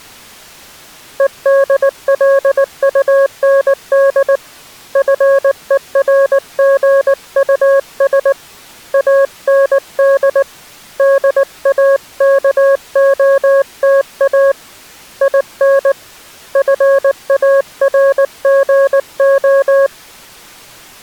Morse code, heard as a keyed tone, hand-sent with a paddle, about 19 wpm, 550 Hz. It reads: EDLUND FERGUS AND DAKOTA IN FARGO